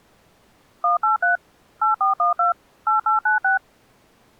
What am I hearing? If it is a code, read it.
DTMF, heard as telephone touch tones, dialled by machine, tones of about 130 ms. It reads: 183 8412 8896